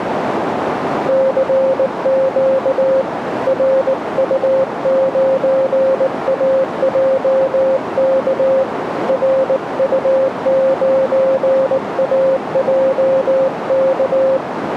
Morse code, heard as a keyed tone, hand-sent with a bug key, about 19 wpm, 530 Hz, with radio static and a narrow filter. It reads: CQ RU9AJK RU9AJK